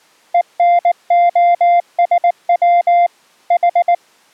Morse code (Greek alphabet), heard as a keyed tone, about 19 wpm, 700 Hz. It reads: ΕΝΟΣΩ Η